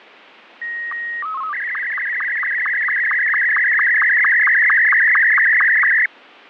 SSTV (slow-scan television), Martin M2, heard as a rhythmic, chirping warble, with radio static and fading.